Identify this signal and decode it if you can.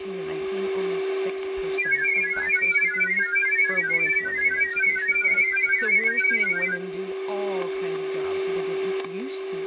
Multi-tone FSK (Olivia or MFSK type), about 1000 Hz wide, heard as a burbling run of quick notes, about 31.25 baud, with static crashes, a steady whistle near 380 Hz, room echo and speech in English.